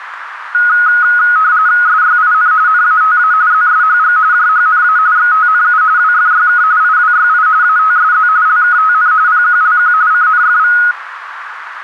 RTTY (45.45 baud, 170 Hz shift), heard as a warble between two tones, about 1360 Hz centre, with radio static and a narrow filter. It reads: SYIN NATA ZSHG JHNA XTNU WFYK IWYI ATSZ LKTN PQLQ CNFV